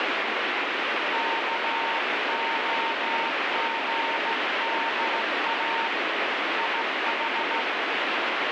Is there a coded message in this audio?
Yes: Morse code (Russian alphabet) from 1.1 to 7.7 s, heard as a keyed tone, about 15 wpm, 920 Hz, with heavy radio static. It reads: КОГДА ИХ